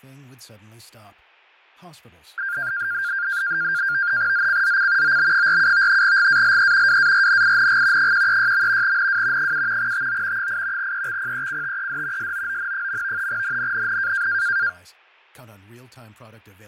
NAVTEX (SITOR-B), 100 baud, 170 Hz shift, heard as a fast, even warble, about 1500 Hz centre, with fading and speech in English. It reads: ZCZC OB47 GALE WARNING 136. NW 7 TO 8 EXPECTED SOON. NNNN